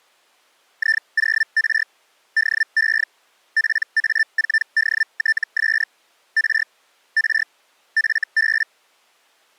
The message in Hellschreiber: I0R DE PA4DTS R R FB

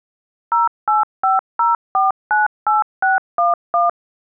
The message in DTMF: 0850498611

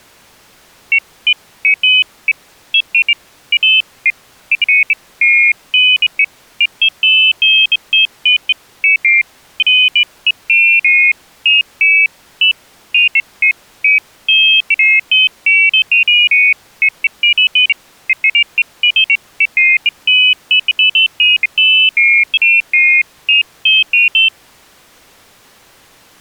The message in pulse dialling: none

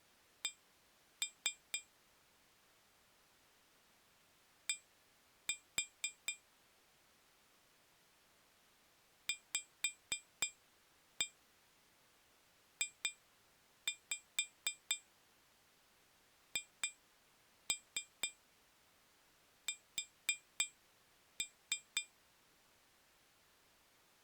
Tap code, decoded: C D VJHS

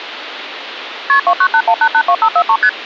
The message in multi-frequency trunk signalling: KP 2981882543 ST

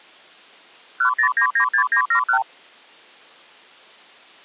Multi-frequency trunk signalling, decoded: 10996971

